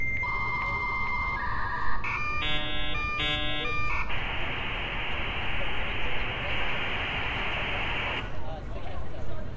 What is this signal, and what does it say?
Dial-up modem handshake (V.34 or later), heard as a whistle, warbles, then hiss, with room echo and street noise.